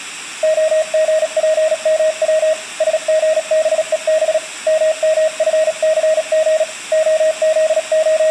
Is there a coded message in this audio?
Yes: Morse code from 0.4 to 8.3 s, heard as a keyed tone, hand-sent with a paddle, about 37 wpm, 630 Hz. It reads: OGPMW SGBEB MMFCG …